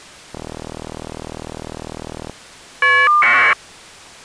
Caller ID data burst, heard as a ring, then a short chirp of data, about 1200 baud.